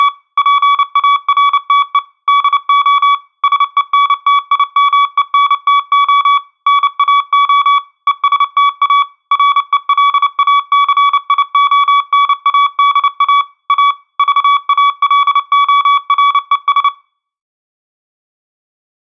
Morse code, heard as a keyed tone, machine-sent, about 29 wpm, 1140 Hz, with room echo. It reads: … PARTE DO SENTIMENTO NAO ESTA RELACIONADA A VALORES